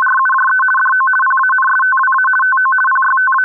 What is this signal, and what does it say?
RTTY (50 baud, 450 Hz shift), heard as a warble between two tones, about 1290 Hz centre. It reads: … DO PANSTWA TO …